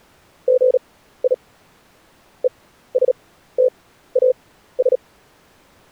Morse code, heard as a keyed tone, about 37 wpm, spaced as for 15 wpm, 510 Hz. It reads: GI ESTAS